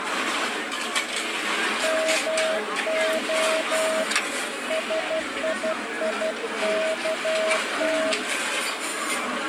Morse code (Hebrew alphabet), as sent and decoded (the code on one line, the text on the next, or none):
-- --- / ... .. .. -.- -
מה שייכת